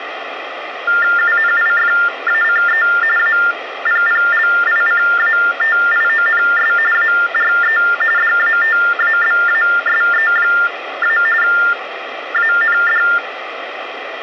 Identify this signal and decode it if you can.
TTY/TDD text telephone tones (45.45 baud Baudot), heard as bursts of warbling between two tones, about 400 Hz shift, 1600 Hz centre, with phone line noise. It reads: UNIFACE APPLICATIONS ARE DATABASE- AND